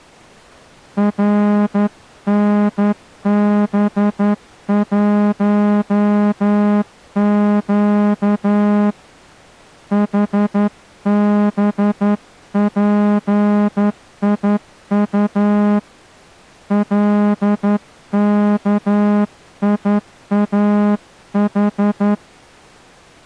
Morse code, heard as a horn, hand-sent with a straight key, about 11 wpm. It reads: RNB1Q HBPIU LKIAH